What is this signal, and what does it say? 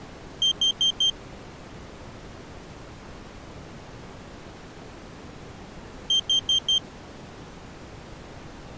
Alarm pattern, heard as an alarm's beeps, played twice, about 3150 Hz. Temporal four. Carbon monoxide.